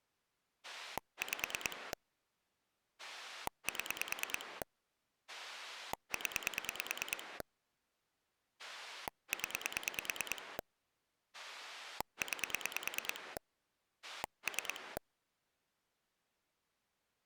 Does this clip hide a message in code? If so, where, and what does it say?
Yes: pulse dialling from 0.6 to 15.0 s, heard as a rotary dial, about 9 pulses a second. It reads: 5 7 0 0 9 3